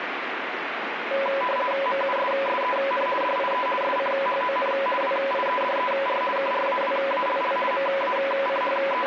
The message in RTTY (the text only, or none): MUSSEN DIE SCHON WIEDER KRAWALL …